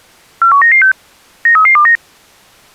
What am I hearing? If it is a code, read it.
Five-tone selective call (CCIR), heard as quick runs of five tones, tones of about 100 ms. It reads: 41996 93329